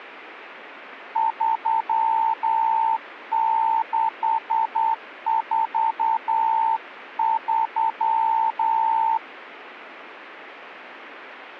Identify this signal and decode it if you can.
Morse code, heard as a keyed tone, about 9 wpm, 900 Hz. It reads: 3643